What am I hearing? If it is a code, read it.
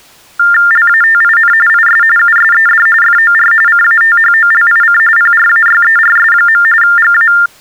TTY/TDD text telephone tones (45.45 baud Baudot), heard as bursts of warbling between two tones, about 400 Hz shift, 1600 Hz centre. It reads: LATIN IS USED FOR CATHOLIC PRAYERS. GA